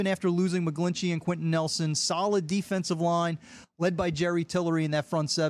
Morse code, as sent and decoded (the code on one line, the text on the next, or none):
none